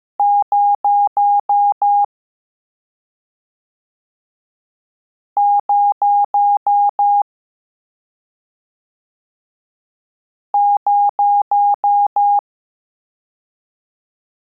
Beep code, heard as beeps, played three times, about 820 Hz. 6 short. In AMI BIOS tables: keyboard controller gate A20 failure; in Dell tables: video card failure.